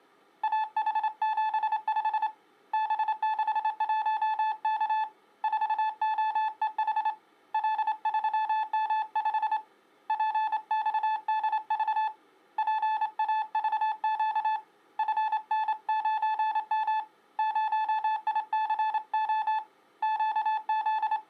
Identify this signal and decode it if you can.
Morse code, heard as a keyed tone, hand-sent with a straight key, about 27 wpm, 870 Hz. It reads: AH75 B61K 4OEH L3M5 PXDV PAVQ FN9M 0ICO …